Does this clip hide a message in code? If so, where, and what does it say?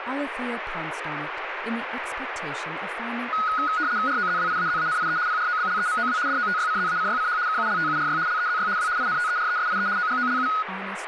Yes: RTTY (75 baud, 170 Hz shift) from 3.3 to 10.6 s, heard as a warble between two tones, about 1360 Hz centre, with radio static and speech in English. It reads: ROZWIAZANIE PROBLEMOW DOTYCZACYCH KULTURY LEZY W INTERESIE OGOLU